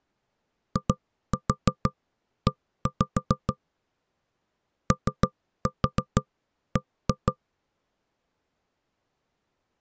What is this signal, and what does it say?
Tap code, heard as knocks on wood, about 6 knocks a second. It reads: IE OB